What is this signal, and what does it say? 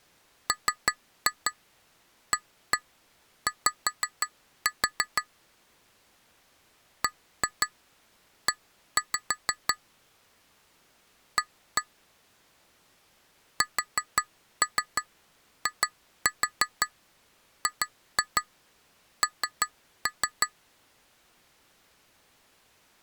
Tap code, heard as taps on glass, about 5 knocks a second. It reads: MAY BE A SIGN